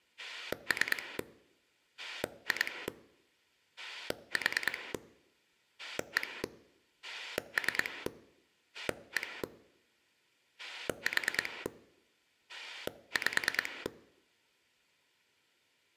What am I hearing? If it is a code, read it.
Pulse dialling, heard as a rotary dial, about 9 pulses a second. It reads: 3 2 4 1 3 1 4 5